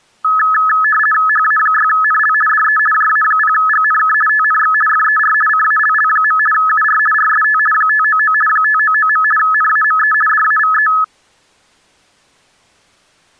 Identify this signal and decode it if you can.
RTTY (50 baud, 450 Hz shift), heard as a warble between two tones, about 1500 Hz centre. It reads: HA6NL DE JA0GNK TNX FER CALL. UR RST 599 599. NAME DAVE